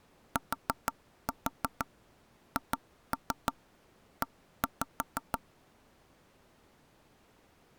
Tap code, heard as knocks on wood, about 6 knocks a second. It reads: THE